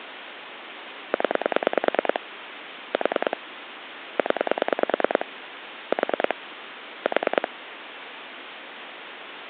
Pulse dialling, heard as clicks on a phone line, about 9 pulses a second, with phone line noise. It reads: 0 4 0 4 4